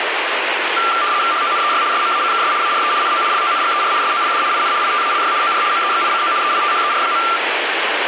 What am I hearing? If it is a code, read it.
RTTY (75 baud, 170 Hz shift), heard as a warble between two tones, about 1270 Hz centre, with radio static. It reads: HONEY SMACKS ARE NO LONGER SOLD IN ITALY OR MEXICO EITHER.